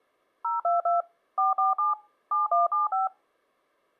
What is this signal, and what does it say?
DTMF, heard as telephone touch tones, dialled by machine, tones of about 150 ms. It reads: 022 447 7175